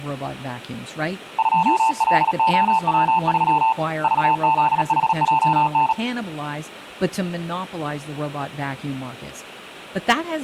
Morse code, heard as a keyed tone, hand-sent with a paddle, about 37 wpm, 890 Hz, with speech in English. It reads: 2LOW3 VZHJN